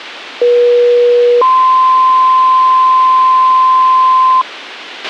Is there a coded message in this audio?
Yes: two-tone page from 0.4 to 4.4 s, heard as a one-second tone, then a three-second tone, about 480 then 1040 Hz, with a squelch burst at the end.